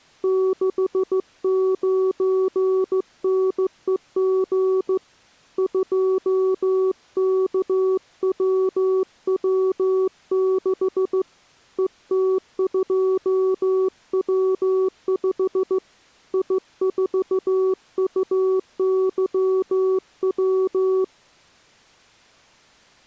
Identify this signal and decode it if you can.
Morse code, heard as a keyed tone, hand-sent with a straight key, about 15 wpm, 380 Hz. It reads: 69NEG 2KWW6 ET2W5 I4UYW